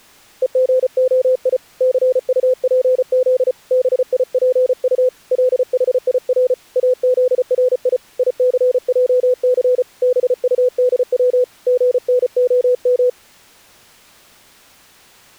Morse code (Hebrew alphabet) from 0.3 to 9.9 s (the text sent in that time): וגהי סטפז ביפט לחיר אזרי יסעס